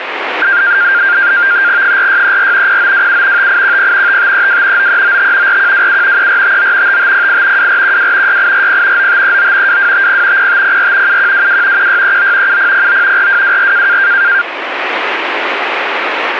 NAVTEX (SITOR-B), 100 baud, 170 Hz shift, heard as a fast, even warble, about 1500 Hz centre, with radio static. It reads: 4634 0927 5810 5532 9395 4127 3459 5508 2412 6840 9539 2250 0504 7122 1639 7009 4224